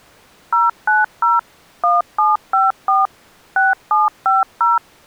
DTMF, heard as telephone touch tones, dialled by machine, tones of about 170 ms. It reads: 090 1754 6750